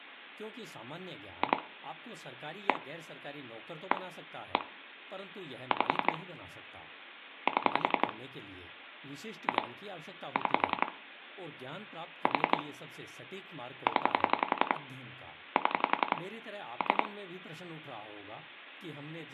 Pulse dialling, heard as clicks on a phone line, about 11 pulses a second, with room echo and speech in Hindi. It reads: 2 1 1 1 5 7 2 6 4 0 7 3